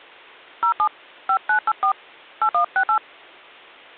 DTMF, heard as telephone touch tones, dialled by hand, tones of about 70 ms. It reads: 07 5984 8168